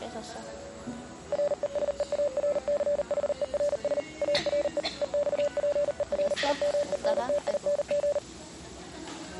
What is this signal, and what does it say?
Morse code, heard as a keyed tone, machine-sent, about 39 wpm, 580 Hz, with the noise of a restaurant. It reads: RESEARCHERS ARE EXPERIMENTING